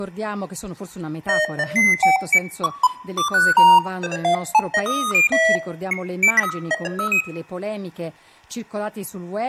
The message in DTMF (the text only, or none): none